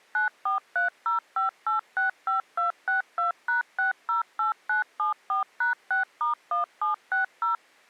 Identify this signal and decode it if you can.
DTMF, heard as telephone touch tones, dialled by machine, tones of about 130 ms. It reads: 94305865262#608974#6*1760